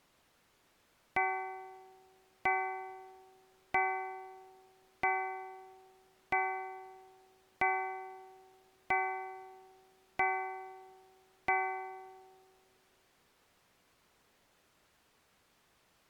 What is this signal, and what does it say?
Clock strike, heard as a bell. 9. Nine o'clock.